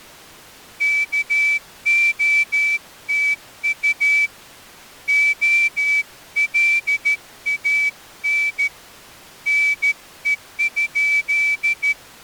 Morse code, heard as a whistle, hand-sent with a straight key, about 13 wpm. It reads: KOTU OLAN NE?